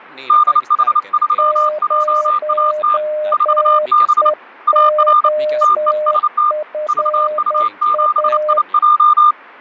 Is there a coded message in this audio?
Yes: Morse code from 0.2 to 9.4 s, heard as two keyed tones, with radio static and speech in Finnish. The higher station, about 29 wpm, 1210 Hz: DH3JAT 4B AR TEST VU7IJ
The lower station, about 10 wpm, 610 Hz: 0EOFA